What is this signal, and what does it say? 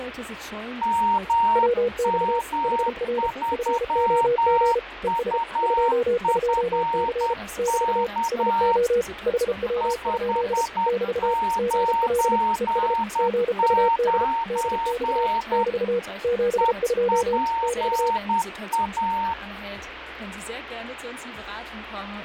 Morse code, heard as two keyed tones, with radio static and fading. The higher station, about 10 wpm, 920 Hz: MM3UFK 599 EPA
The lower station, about 33 wpm, 480 Hz: WX HR FOG ES 22C <BT> SO HW? <BT> GL ES GUD DX <BT> 72 <BT>